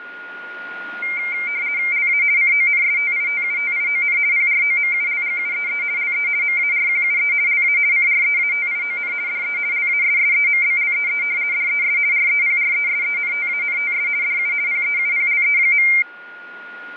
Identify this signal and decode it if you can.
RTTY (50 baud, 170 Hz shift), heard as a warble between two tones, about 2200 Hz centre, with radio static and a steady whistle near 1430 Hz. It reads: LA CONSTITUTION PROMULGUEE LE MARQUE LA CREATION DE LASSEMBLEE DES REPRESENTANTS DU PEUPLE.